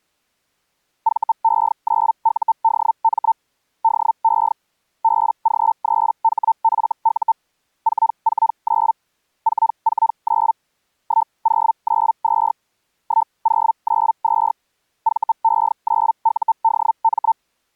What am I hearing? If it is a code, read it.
Hellschreiber (Feld-Hell, 122.5 baud), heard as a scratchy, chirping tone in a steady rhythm, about 900 Hz. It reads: VE9UDM DE BG3HFU 449 449 1092 1092 VE9UDM